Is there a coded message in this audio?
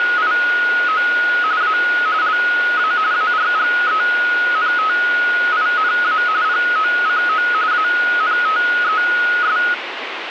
Yes: RTTY (45.45 baud, 170 Hz shift) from 0.0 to 9.7 s, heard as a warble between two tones, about 1360 Hz centre, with radio static. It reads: … A LA ARGENTINA POCO ANTES